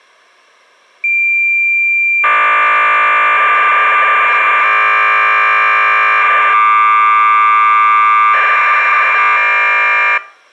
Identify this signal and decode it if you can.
Cassette data (Kansas City type), 1200 baud, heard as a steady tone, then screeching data.